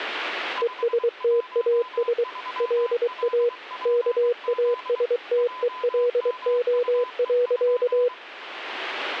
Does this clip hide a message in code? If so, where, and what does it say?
Yes: Morse code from 0.6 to 8.1 s, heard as a keyed tone, machine-sent, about 23 wpm, 480 Hz, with radio static and a weaker station near 1010 Hz. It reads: ESTAS LA KASTELO.